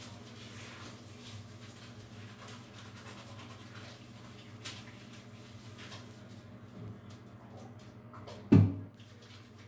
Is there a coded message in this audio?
No, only the noise of a restroom.